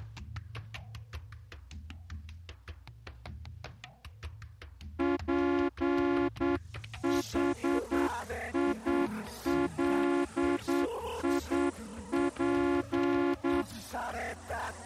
Morse code, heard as a horn, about 8 wpm. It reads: PHILIP